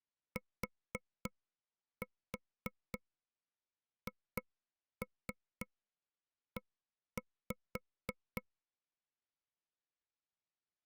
Tap code, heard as taps on a table, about 3 knocks a second. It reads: THE